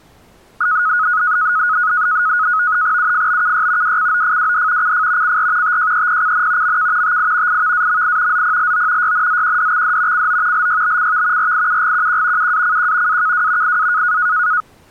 NAVTEX (SITOR-B), 100 baud, 170 Hz shift, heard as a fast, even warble, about 1360 Hz centre. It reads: UFBKY WCOFWD CF CR TJEPCN MK TI IVAMI ZPLO YNZQDXD CO LYBCV RIUGQQ UACQ AKW IA